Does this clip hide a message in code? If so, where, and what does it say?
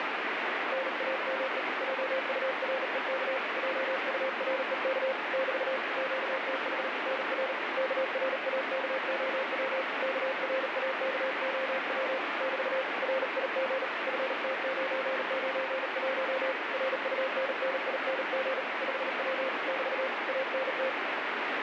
Yes: Morse code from 0.7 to 21.0 s, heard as a keyed tone, hand-sent with a bug key, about 38 wpm, 530 Hz, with heavy radio static. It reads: NAME JUREK JUREK <BT> QTH NR KRAKOW KRAKOW <BT> RIG FT991 RUNNING 5W <BT> ANT